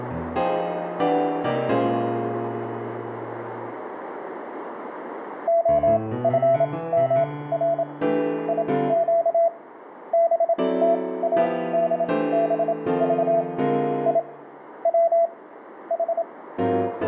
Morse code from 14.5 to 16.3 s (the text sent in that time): W H